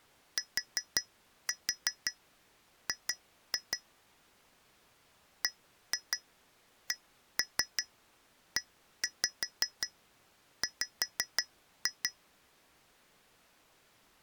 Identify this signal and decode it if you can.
Tap code, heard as taps on glass, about 5 knocks a second. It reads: TG BCEW